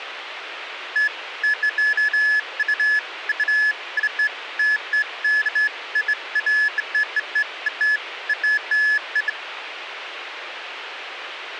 Beeps of irregular length, with radio hiss and a squelch burst at the end. There is no code.